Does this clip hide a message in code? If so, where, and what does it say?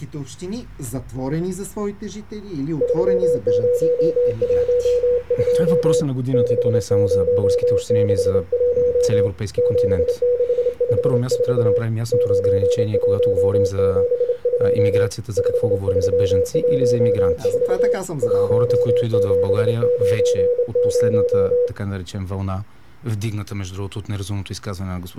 Yes: Morse code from 2.8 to 21.7 s, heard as a keyed tone, hand-sent with a straight key, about 28 wpm, 490 Hz. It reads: 3012 6061 7654 9172 5314 1790